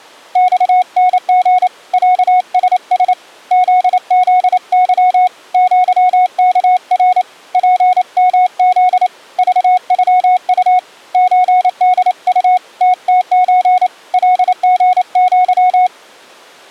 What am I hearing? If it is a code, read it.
Morse code (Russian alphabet), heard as a keyed tone, hand-sent with a paddle, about 28 wpm, 730 Hz. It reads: ЬНГ ЯСС ЗЗЫ ЪКР ПМЗ ЖЮУ ЧДУ ТТЧ ЛГЪ